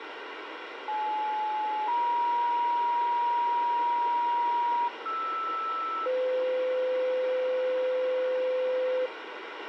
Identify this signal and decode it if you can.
Two-tone page, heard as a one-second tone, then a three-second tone, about 860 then 950 Hz, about 1320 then 510 Hz, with radio hiss and a squelch burst at the end.